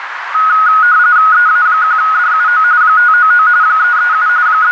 RTTY (45.45 baud, 170 Hz shift), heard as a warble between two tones, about 1360 Hz centre, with radio static and a narrow filter. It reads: EA1DUO 599 337 …